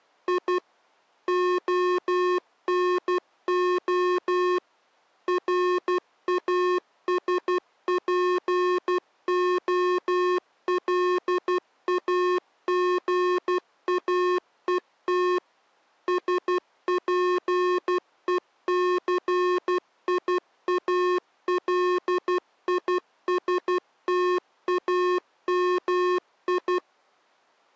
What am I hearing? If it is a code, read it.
Morse code (Russian alphabet), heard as electronic beeps, machine-sent, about 12 wpm, 360 Hz. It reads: И ОНО РАСПОЛАГАЕТ СПЕЦИАЛИСТАМИ